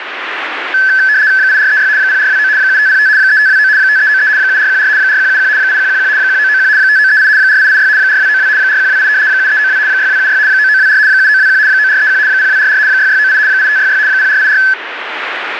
RTTY (75 baud, 170 Hz shift), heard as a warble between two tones, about 1600 Hz centre, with radio static. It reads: 8436 0429 7505 3529 5393 7414 4171 8111 1991 5938 4886 4292 4128 7392 6276 9924 7921 9431 0244 6698 8566 0484